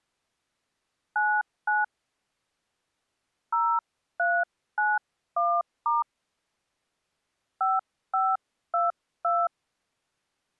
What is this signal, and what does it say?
DTMF, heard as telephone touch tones, dialled by hand, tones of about 230 ms. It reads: 99 0391* 5522